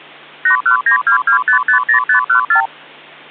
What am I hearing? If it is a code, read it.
Multi-frequency trunk signalling (R2, with the far end's replies), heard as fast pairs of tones, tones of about 100 ms, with hum. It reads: 81922550514